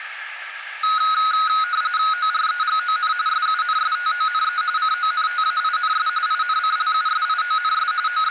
RTTY (45.45 baud, 170 Hz shift), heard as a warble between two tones, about 1360 Hz centre, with radio static. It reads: OREGON SUNSTONE CONTAINS INCLUSIONS …